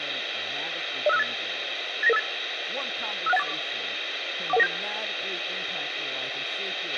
Five-tone selective call (EIA), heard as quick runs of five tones, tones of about 30 ms, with radio hiss, a squelch burst at the end, room echo and speech in English. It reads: 05658 89958 56184 41197